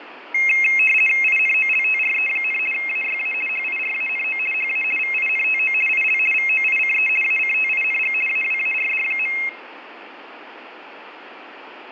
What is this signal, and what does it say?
RTTY (50 baud, 450 Hz shift), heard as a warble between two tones, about 2350 Hz centre, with radio static and fading. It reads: INOLTRE, AYA HIRANO HA VINTO IL VOICE ACTING AWARD.